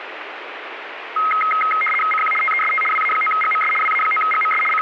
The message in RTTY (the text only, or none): CQ TEST WA9GMS WA9GMS …